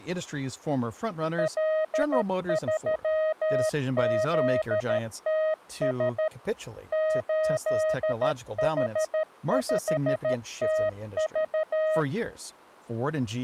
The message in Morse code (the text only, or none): L3ZTS 8H5TV